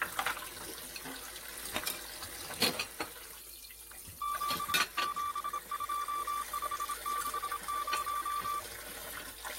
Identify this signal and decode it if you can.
Morse code, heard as a keyed tone, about 27 wpm, 1170 Hz, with kitchen noise. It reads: 772560